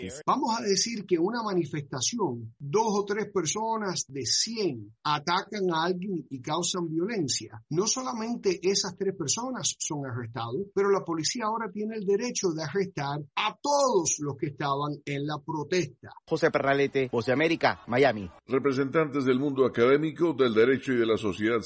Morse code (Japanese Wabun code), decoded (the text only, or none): none